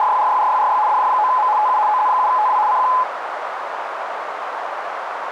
RTTY (75 baud, 170 Hz shift), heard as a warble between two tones, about 930 Hz centre, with radio static and a narrow filter. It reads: … DJ9M TU OZ7TW CQ